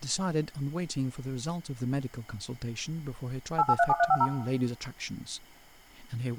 DTMF, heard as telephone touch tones, dialled by machine, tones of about 50 ms, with room echo and speech in English. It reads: 8837350